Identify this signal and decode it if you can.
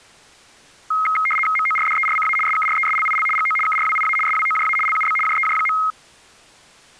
RTTY (75 baud, 850 Hz shift), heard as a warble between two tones, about 1700 Hz centre. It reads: MORDERCA SKRESLIL GO KRWIA SWOJA LUB JEJ.